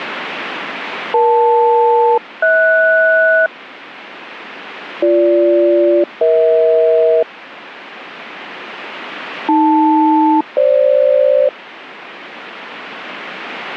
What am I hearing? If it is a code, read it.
Aircraft SELCAL, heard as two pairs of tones. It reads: EL-HS BG-EH AL-FG